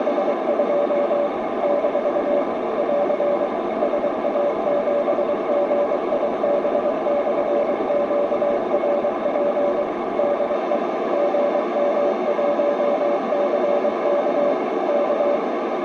Morse code, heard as a keyed tone, machine-sent, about 23 wpm, 580 Hz, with heavy radio static and a narrow filter. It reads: … - <AR> SA7GIB/QRP DE GM1CK K